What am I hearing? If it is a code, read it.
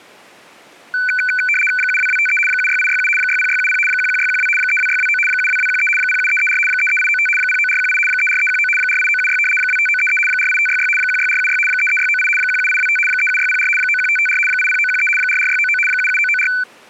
RTTY (75 baud, 850 Hz shift), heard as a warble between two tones, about 1900 Hz centre. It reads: 72253 76867 60670 11612 32629 72213 07334 33895 09418 34319 48976 25933 48566 16476 33698 17825 37604 91554 80913 44699 77994